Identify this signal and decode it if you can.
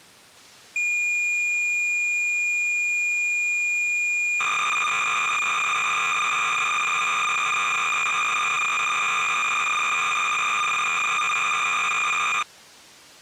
Cassette data (Kansas City type), 300 baud, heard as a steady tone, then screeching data.